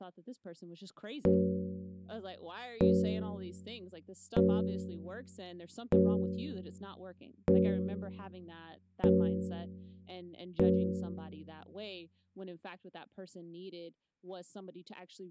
Clock strike, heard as a bell, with room echo and speech in English. 7. Seven o'clock.